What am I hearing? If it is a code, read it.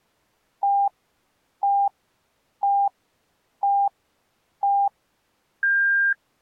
Radio time signal (five pips and a higher one, as on Chinese radio), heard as pips.